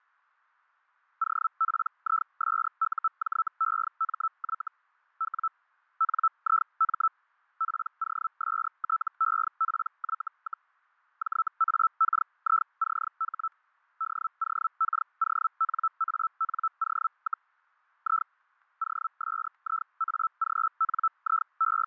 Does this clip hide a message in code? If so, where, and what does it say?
Yes: Hellschreiber (Feld-Hell, 122.5 baud) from 1.2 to 21.9 s, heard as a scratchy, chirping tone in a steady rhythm, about 1320 Hz, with fading and static crashes. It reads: OPISUJEMY W NIM POSTEPY, JAKICH DOKONANO, I …